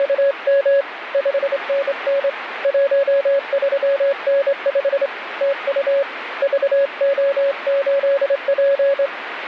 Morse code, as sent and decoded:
… / ..... -. -. / .---- ...-- -. ..... / - ..- / ...- --- ---.. .--.
… 5NN 13N5 TU VO8P

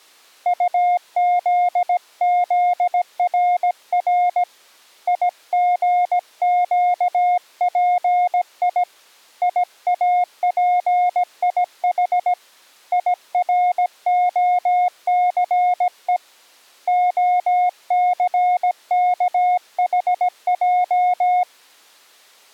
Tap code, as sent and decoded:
none

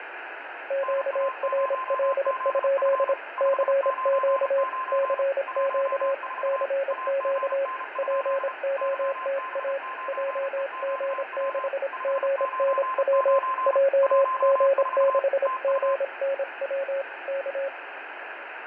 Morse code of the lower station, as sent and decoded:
--.- .-. .-.. ..--.. / -.-. --.- / -.-. --.- / -.-. --.- / .--. --- - .- / .--- --. -.... --. -. .-- / .--- --. -.... --. -. .-- / -.-
QRL? CQ CQ CQ POTA JG6GNW JG6GNW K

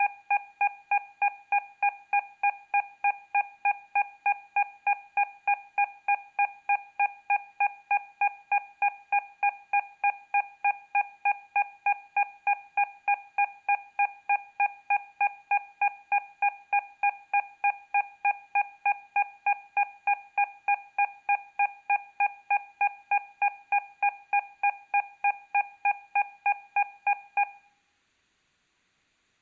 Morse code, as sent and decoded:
none

